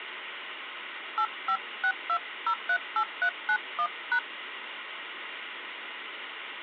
DTMF, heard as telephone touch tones, dialled by hand, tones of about 70 ms, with phone line noise. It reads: 8562038391#